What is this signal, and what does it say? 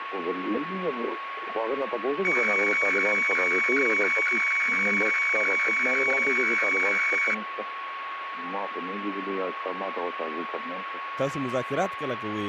Weather fax (radiofax), 120 lines a minute, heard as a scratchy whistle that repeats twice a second, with radio static and a steady whistle near 1100 Hz.